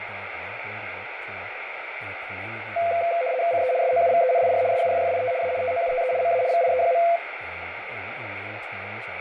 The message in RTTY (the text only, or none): CE SOUVENIR SUFFIT A TOUTE MA VIE.